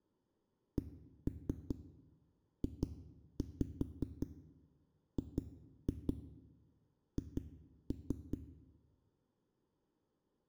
Tap code, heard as knocks on a wall, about 5 knocks a second, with room echo. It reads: CJGH